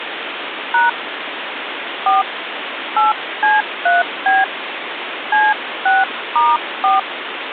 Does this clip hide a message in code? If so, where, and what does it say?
Yes: DTMF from 0.7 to 7.0 s, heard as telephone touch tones, dialled by hand, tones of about 190 ms, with phone line noise. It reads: # 4 8C3B C6*4